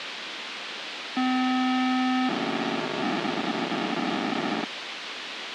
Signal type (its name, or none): POCSAG pager data